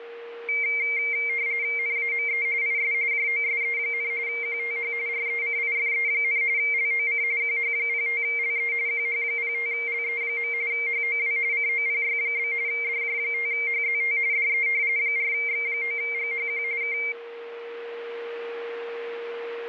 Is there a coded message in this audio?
Yes: RTTY (45.45 baud, 170 Hz shift) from 0.5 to 17.1 s, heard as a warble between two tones, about 2200 Hz centre, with a steady whistle near 470 Hz. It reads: NAME IS JOSE, QTH RECIFE, LOC QH05LE QH05LE. HOW COPY? DJ5HZT DE 4X9GHQ K